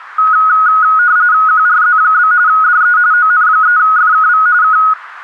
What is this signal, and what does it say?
RTTY (45.45 baud, 170 Hz shift), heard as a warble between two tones, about 1360 Hz centre. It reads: QRZ? DE ON3FKV K